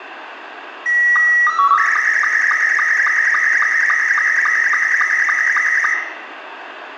SSTV (slow-scan television), Scottie S2, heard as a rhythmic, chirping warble, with radio static and room echo.